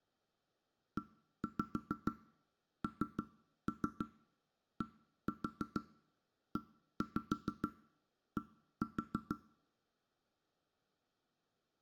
Tap code, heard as knocks on wood, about 6 knocks a second. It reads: ENDED